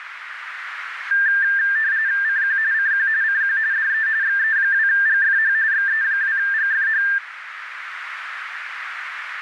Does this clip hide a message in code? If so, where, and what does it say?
Yes: RTTY (45.45 baud, 170 Hz shift) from 1.1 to 7.2 s, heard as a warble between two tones, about 1700 Hz centre, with radio static and a narrow filter. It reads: CQ CQ CQ DE XE2GFH XE2GFH